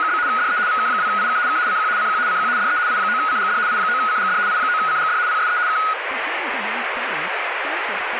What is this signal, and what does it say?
RTTY (75 baud, 170 Hz shift), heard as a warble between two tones, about 1360 Hz centre, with radio static. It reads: … DE VK2IK K CQ CQ CQ DE I9CGD I9CGD I9CGD PSE K